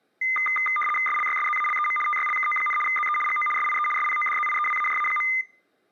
RTTY (75 baud, 850 Hz shift), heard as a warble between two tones, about 1650 Hz centre. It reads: SLYSZALEM TYLKO, ZE GO SIE SPODZIEWAJA.